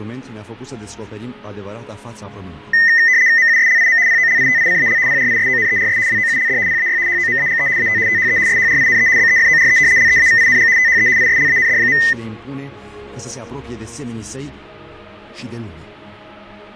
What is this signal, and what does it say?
RTTY (75 baud, 170 Hz shift), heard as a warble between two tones, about 1900 Hz centre. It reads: MUSLIM POLITICAL PRISONERS WOULD PAY HOMAGE AT THE SHRINE BEFORE LEAVING THE ISLAND.